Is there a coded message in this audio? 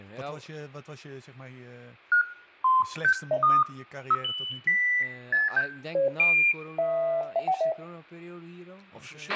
No, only electronic bleeps of random pitch and length, with a squelch burst at the end, room echo and speech in Dutch.